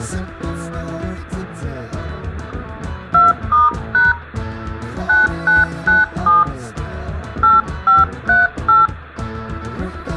DTMF, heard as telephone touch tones, dialled by hand, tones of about 170 ms, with room echo. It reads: 2*# 9997 8538